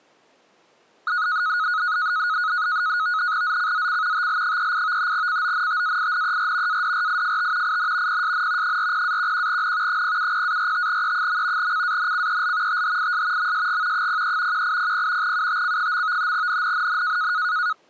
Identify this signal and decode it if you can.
NAVTEX (SITOR-B), 100 baud, 170 Hz shift, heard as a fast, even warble, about 1360 Hz centre. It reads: ZCZC TL38 CONTAINER ADRIFT IN PSN 40-11N 070-45E. CANCEL THIS MSG 03 1800 UTC. NNNN